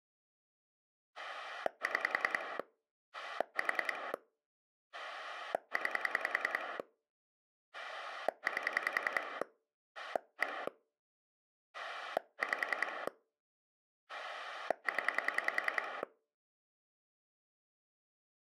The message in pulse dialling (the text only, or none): 6 4 9 8 1 5 0